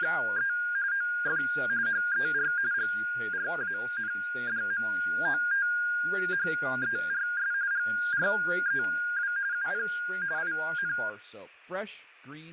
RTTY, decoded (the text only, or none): … OF HER GRANDMOTHERS GREW UP IN